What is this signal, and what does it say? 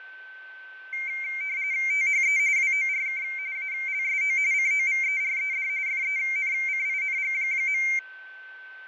RTTY (45.45 baud, 170 Hz shift), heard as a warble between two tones, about 2200 Hz centre, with fading and a steady whistle near 1540 Hz. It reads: THE WORK ALSO COVERED FENCING.